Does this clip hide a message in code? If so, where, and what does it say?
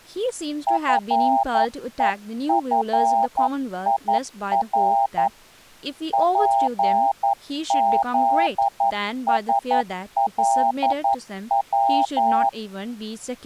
Yes: Morse code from 0.6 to 12.6 s, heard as a keyed tone, hand-sent with a paddle, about 11 wpm, 800 Hz, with speech in English. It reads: FEFIR PZSLW